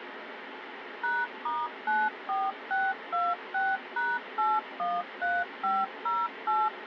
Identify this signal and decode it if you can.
DTMF, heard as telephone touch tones, dialled by machine, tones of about 210 ms, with radio hiss. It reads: #*94626#813508